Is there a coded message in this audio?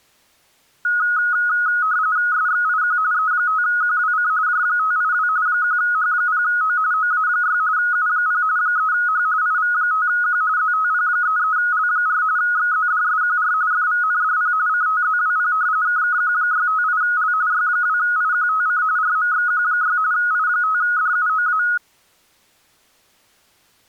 Yes: RTTY (45.45 baud, 170 Hz shift) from 0.8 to 21.8 s, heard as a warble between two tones, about 1360 Hz centre. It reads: SXIQ E5QWC J582 1H0O OA6 U0 3H IV5Q ZTP33L4 XZDSQR FVNDP CTZWP KKQ658L Y2IQTC RMXQ6 I5DUOA